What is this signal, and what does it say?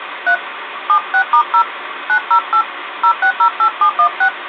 DTMF, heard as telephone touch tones, dialled by hand, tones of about 80 ms, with phone line noise. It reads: 3 76*0 908 0608716